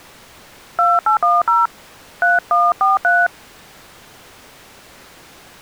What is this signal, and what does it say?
DTMF, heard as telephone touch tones, dialled by hand, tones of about 160 ms. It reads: 2810 3143